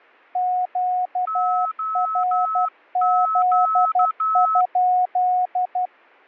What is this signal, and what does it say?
Morse code, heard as two keyed tones. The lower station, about 12 wpm, 730 Hz: QRZ?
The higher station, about 12 wpm, 1300 Hz: OQ